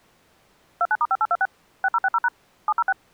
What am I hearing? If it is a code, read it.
DTMF, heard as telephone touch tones, dialled by machine, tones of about 40 ms. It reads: 29*5826 6060# 706